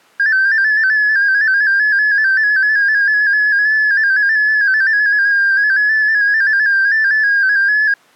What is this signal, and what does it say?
Multi-tone FSK (Olivia or MFSK type), about 250 Hz wide, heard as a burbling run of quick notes, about 15.625 baud.